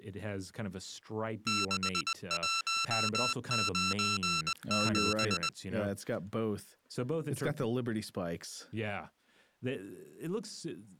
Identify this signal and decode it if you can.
Morse code, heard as electronic beeps, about 20 wpm, 1340 Hz, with speech in English. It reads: 6197